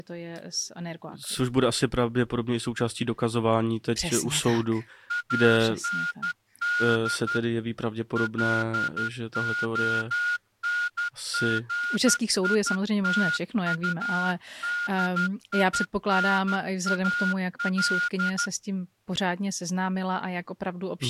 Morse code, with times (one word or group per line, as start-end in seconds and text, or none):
5.1-7.4 AND
8.2-18.5 LONGITUDINAL